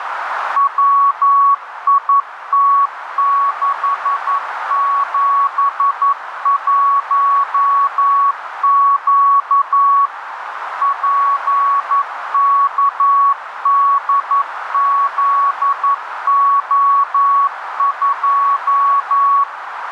Morse code, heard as a keyed tone, machine-sent, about 11 wpm, 1120 Hz, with radio static and a narrow filter. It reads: WIT671Q PKDZO2